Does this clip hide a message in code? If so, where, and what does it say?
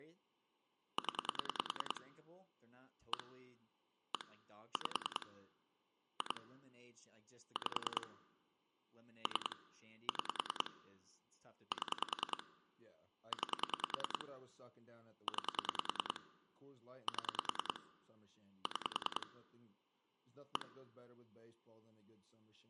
Yes: pulse dialling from 1.0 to 20.6 s, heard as clicks on a phone line, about 10 pulses a second, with speech in English. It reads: 0 1 1 5 2 5 3 6 7 9 9 7 6 1